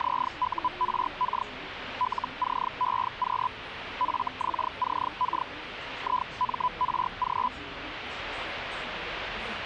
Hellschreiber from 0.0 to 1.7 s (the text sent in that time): ZURK